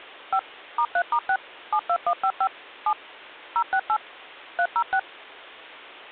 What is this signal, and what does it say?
DTMF, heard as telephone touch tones, dialled by machine, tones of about 70 ms. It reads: 5 *3*6 72155 7 068 306